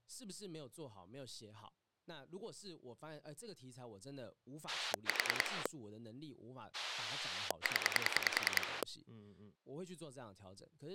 Pulse dialling, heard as a rotary dial, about 10 pulses a second, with speech in Chinese. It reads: 4 0